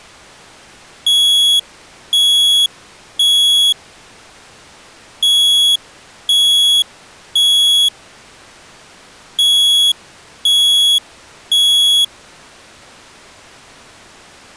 Alarm pattern, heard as an alarm's beeps, played three times, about 3350 Hz. Temporal three. Smoke or fire, evacuate.